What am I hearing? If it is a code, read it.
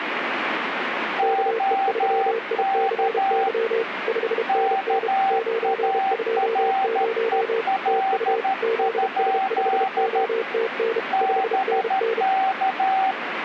Morse code, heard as two keyed tones, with radio static. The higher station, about 13 wpm, 770 Hz: OK KAREL? BK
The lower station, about 32 wpm, 450 Hz: KE3ICY 5NN 920 TU ZS5OTN 5NN